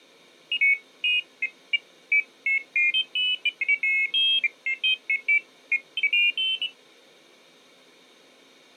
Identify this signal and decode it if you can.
Pairs of high tones at irregular times. There is no code.